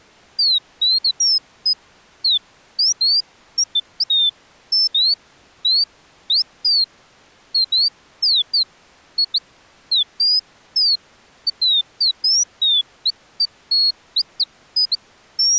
Bird-like chirps. There is no code.